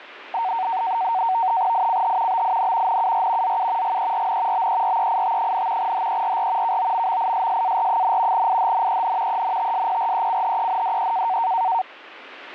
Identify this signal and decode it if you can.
NAVTEX (SITOR-B), 100 baud, 170 Hz shift, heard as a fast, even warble, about 830 Hz centre. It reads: ICH BIN NUR ZU GERN BEREIT, HERR KOMMISSAR, IHNEN ENTSPRECHENDE